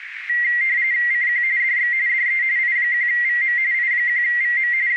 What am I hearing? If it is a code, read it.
RTTY (45.45 baud, 170 Hz shift), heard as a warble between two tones, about 2000 Hz centre, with radio static and a narrow filter. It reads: CQ DX DE I1VM I1VM …